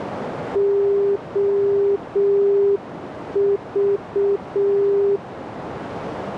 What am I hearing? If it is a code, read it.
Morse code, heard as a keyed tone, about 6 wpm, 400 Hz, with radio static and a narrow filter. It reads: OV